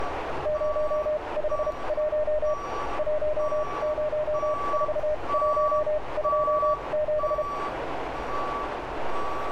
Morse code, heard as a keyed tone, machine-sent, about 32 wpm, spaced as for 25 wpm, 610 Hz, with radio static, a narrow filter and street noise. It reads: 051 104127